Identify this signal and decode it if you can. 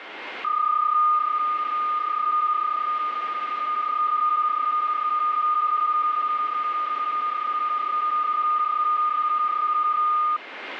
PSK31 (31.25 baud), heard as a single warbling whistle, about 1220 Hz, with radio static and a steady whistle near 2120 Hz.